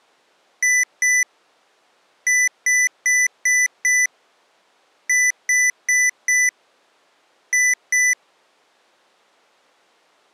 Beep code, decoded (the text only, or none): 2-5-4-2